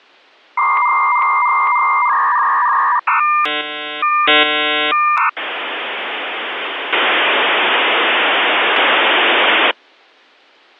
Dial-up modem handshake (V.34 or later), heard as a whistle, warbles, then hiss.